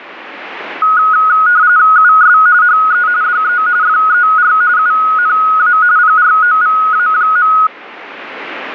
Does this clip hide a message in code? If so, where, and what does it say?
Yes: RTTY (45.45 baud, 170 Hz shift) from 0.8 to 7.7 s, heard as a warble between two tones, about 1360 Hz centre, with radio static. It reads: US HE DE FER UNA PROVA.